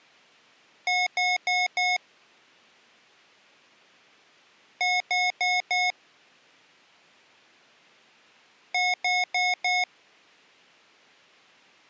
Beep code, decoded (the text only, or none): 4 short